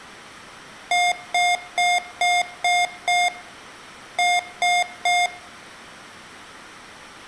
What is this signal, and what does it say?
Beep code, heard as beeps from a small speaker, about 710 Hz. 6-3.